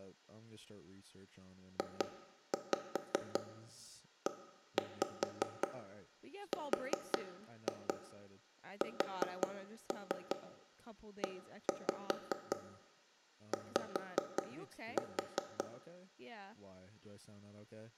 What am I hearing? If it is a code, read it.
Tap code, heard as knocks on wood, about 5 knocks a second, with room echo and speech in English. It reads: JERSEY